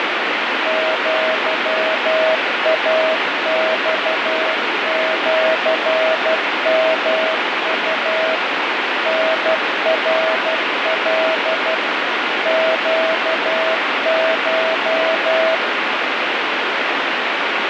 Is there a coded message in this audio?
Yes: Morse code (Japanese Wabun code) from 0.6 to 15.6 s, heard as a keyed tone, machine-sent, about 12 wpm, 640 Hz, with heavy radio static. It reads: アイマシヨウ タナカ ネコ